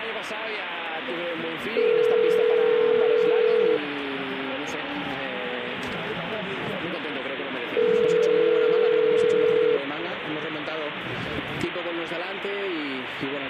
Telephone call progress tone (North American plan), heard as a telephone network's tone, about 440, 480 Hz, 2 s on and 4 s off, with phone line noise. Ringback tone.